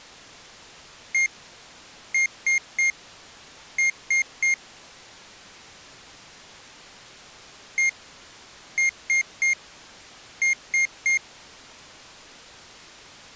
Beep code, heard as a piezo beeper, played twice, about 2150 Hz. 1-3-3. In Phoenix BIOS tables: chip or data line failure in the first 64 KB of memory.